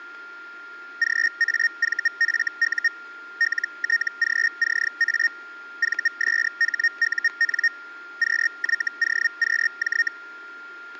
Hellschreiber (Feld-Hell, 122.5 baud), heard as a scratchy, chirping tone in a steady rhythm, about 1850 Hz, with static crashes and a steady whistle near 1400 Hz. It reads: GAVFU LTGCA VSHUN QYOQJ